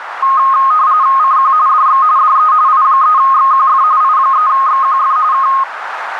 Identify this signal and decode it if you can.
RTTY (45.45 baud, 170 Hz shift), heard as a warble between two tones, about 1160 Hz centre, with radio static and a narrow filter. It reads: CQ DX DE I3XQF I3XQF K